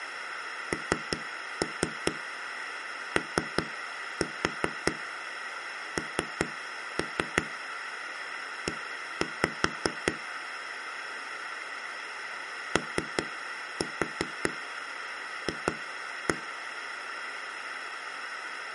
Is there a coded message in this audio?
Yes: tap code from 0.7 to 16.3 s, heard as knocks on a wall, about 5 knocks a second. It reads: NONE OF